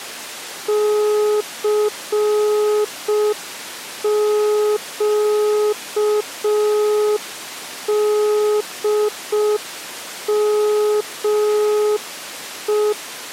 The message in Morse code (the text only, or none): CQDME